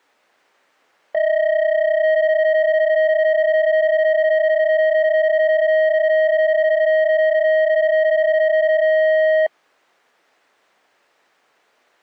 PSK31 (31.25 baud), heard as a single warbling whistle, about 630 Hz.